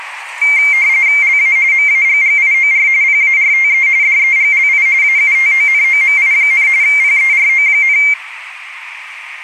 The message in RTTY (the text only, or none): LA MAGGIOR PARTE DEGLI AUTONOMI, PERO,